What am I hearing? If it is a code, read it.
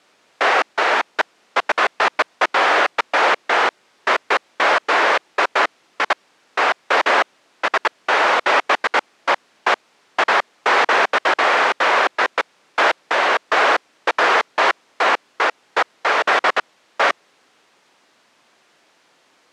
Bursts of noise. There is no code.